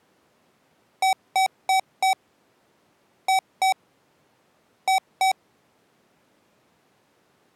Beep code, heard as beeps from a small speaker, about 760 Hz. 4-2-2. In Phoenix BIOS tables: shutdown test failure.